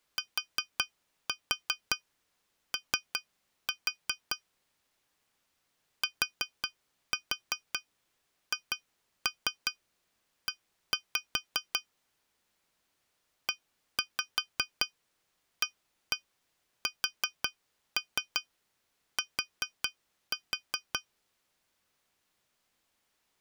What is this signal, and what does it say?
Tap code, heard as taps on glass, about 5 knocks a second. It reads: TO THE EAST